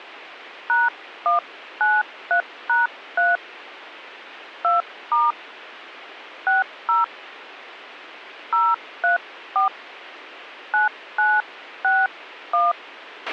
DTMF, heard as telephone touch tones, dialled by hand, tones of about 160 ms, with a squelch burst at the end. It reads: #193#3 2* 60 034 9961